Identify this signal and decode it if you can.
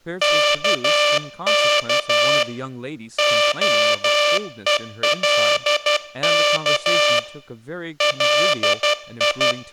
Morse code (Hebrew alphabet), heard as a buzzer, hand-sent with a paddle, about 12 wpm, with speech in English. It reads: כך הולך לי